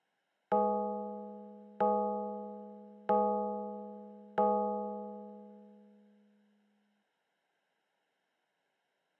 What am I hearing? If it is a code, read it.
Clock strike, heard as a bell. 4. Four o'clock.